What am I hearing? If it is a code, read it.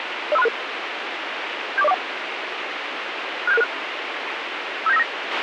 Five-tone selective call (EIA), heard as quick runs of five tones, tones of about 30 ms, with radio hiss and a squelch burst at the end. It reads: 05366 74041 67666 57959